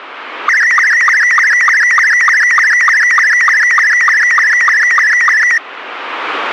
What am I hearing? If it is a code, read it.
SSTV (slow-scan television), Robot 72, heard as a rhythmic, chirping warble.